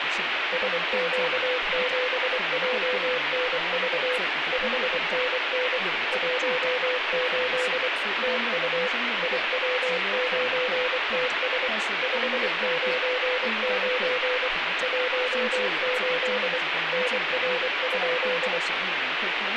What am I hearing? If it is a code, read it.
Morse code, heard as a keyed tone, machine-sent, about 24 wpm, 500 Hz, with radio static and speech in Chinese. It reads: SQ7JNV 5NN 18 TU IW9TS 599 18 NR?